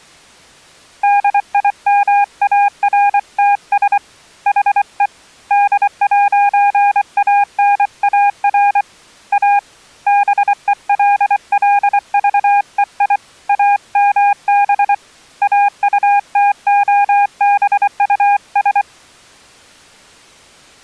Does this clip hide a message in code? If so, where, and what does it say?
Yes: Morse code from 1.0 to 18.9 s, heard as a keyed tone, hand-sent with a paddle, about 24 wpm, 810 Hz. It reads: DIMARTS HE D'ANAR A BELLVEI AMB AUTOBUS